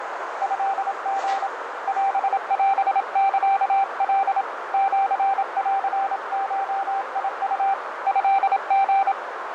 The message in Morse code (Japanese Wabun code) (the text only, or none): トリ オオサカ シンゴウ トリ